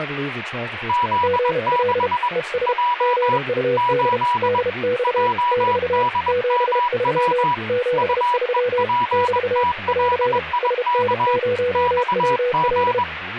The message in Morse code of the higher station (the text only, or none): Z6 J 8 JDMW UEPTLIK XG